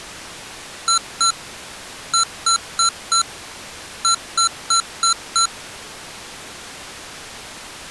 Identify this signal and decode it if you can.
Beep code, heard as beeps from a small speaker, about 1350 Hz. 2-4-5.